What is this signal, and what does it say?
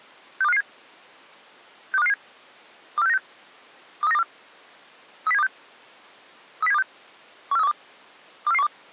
Five-tone selective call (EEA), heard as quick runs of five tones, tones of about 40 ms. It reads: 62557 62557 24696 23924 30726 30726 14312 24412